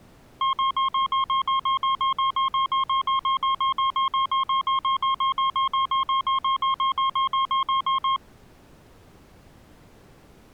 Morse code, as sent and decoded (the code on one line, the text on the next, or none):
none